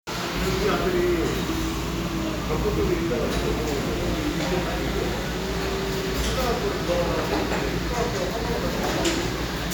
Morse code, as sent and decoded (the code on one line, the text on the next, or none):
none